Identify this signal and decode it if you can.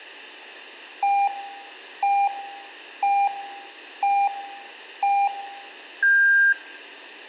Radio time signal (five pips and a higher one, as on Chinese radio), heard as pips, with room echo.